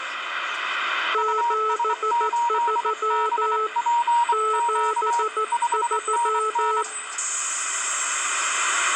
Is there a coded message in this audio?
Yes: Morse code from 1.1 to 6.9 s, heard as two keyed tones, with the noise inside a bus. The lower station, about 14 wpm, 430 Hz: 73 73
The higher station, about 24 wpm, 940 Hz: US8BPQ 5NN